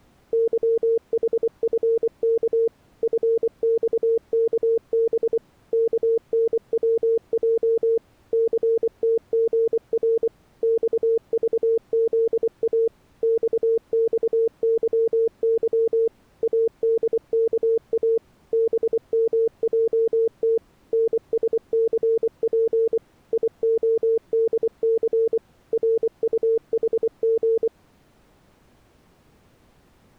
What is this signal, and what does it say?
Morse code, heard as a keyed tone, machine-sent, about 24 wpm, 450 Hz. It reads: YHFK FXKB KNWJ CTGR XVZA XXYY ADKA BMJT NSCP IODC RUHG